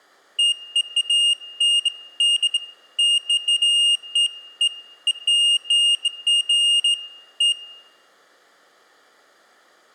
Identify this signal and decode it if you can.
Beeps of irregular length, with room echo. There is no code.